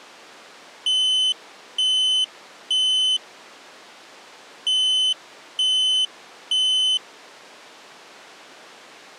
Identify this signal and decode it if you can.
Alarm pattern, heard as an alarm's beeps, played twice, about 3050 Hz. Temporal three. Smoke or fire, evacuate.